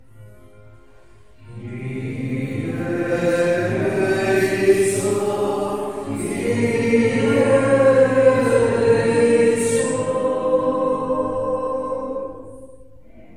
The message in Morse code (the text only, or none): none